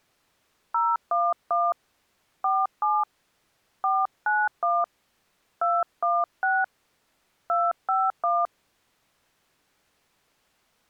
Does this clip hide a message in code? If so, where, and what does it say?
Yes: DTMF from 0.7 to 8.5 s, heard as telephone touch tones, dialled by hand, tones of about 220 ms. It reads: 011 47 491 216 251